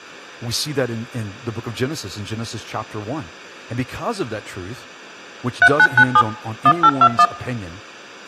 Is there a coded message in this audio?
Yes: DTMF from 5.6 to 7.3 s, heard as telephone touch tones, dialled by machine, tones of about 60 ms, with room echo and speech in English. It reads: 3997 1821